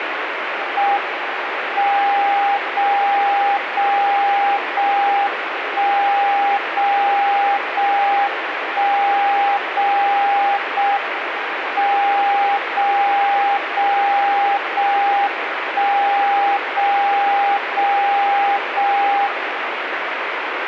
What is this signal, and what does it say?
Radio time signal (JJY), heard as a tone whose level steps once a second, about 800 Hz, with radio static. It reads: M 0 0 0 1 0 0 1 0 0 M 0 0 0 1 0 0 0 1